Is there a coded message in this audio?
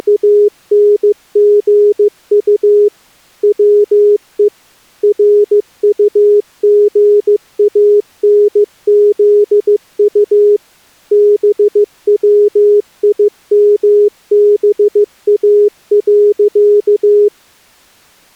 Yes: Morse code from 0.0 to 17.3 s, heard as a keyed tone, machine-sent, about 15 wpm, 410 Hz. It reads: … WE RUGANZU BWIMBA.